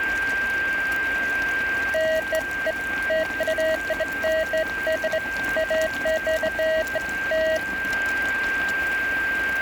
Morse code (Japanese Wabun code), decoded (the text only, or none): none